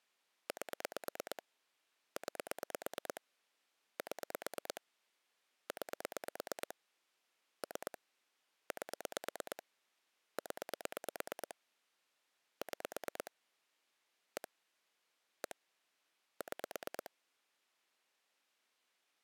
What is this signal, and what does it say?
Pulse dialling, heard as clicks on a phone line, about 9 pulses a second. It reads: 8 9 7 9 3 8 0 6 1 1 6